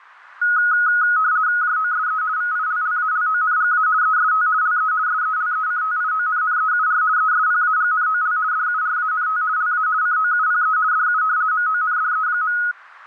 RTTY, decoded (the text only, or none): JOSE VILLALONGA EST LE SELECTIONNEUR ESPAGNOL DURANT LA COUPE DU MONDE.